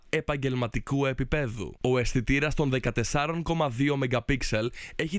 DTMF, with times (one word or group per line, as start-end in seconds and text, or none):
none